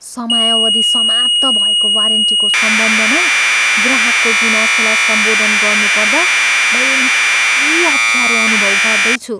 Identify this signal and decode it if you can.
Commodore tape loading (standard loader), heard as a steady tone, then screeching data, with speech in Nepali.